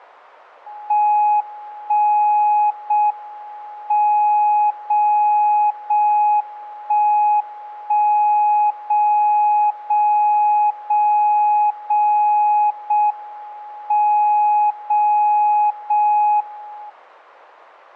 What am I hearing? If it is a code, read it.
Radio time signal (JJY), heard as a tone whose level steps once a second, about 840 Hz. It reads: 1 0 M 0 0 1 1 0 0 0 0 0 M 0 0 1